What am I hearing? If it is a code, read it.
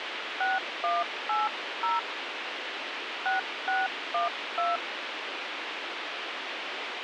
DTMF, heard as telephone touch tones, dialled by hand, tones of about 170 ms, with radio hiss. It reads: 6180 6612